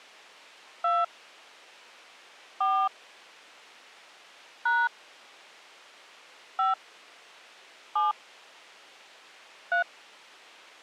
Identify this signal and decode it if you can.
DTMF, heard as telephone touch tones, dialled by hand, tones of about 190 ms. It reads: 2 4 # 5 7 3